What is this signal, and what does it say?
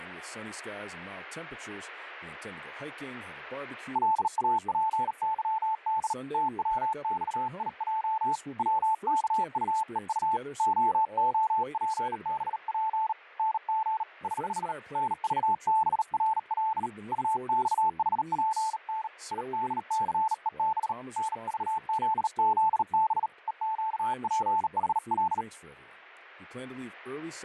Morse code, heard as a keyed tone, hand-sent with a bug key, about 38 wpm, 880 Hz. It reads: LAPYD TWXIJ WKUEU OOPBP NG <HH> NVBRL UXHPN IDCEB NVZZB EQPHL